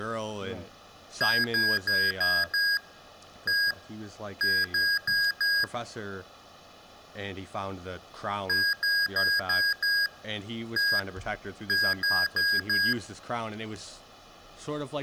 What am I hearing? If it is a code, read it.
Beep code, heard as beeps from a small speaker, played twice, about 1650 Hz, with room echo and speech in English. 5-1-4.